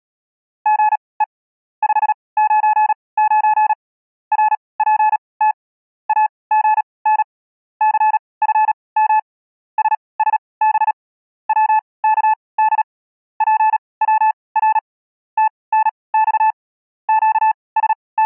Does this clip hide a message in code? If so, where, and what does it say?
Yes: Morse code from 0.6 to 18.3 s, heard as a keyed tone, machine-sent, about 37 wpm, spaced as for 23 wpm, 860 Hz. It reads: GE 599 RPT AGN CFM SSB WKD PWR TNX …